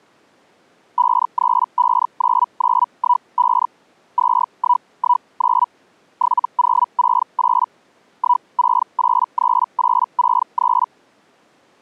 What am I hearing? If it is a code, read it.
Hellschreiber (Feld-Hell, 122.5 baud), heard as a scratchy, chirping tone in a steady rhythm, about 980 Hz. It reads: 5359915 2119 7068 1683863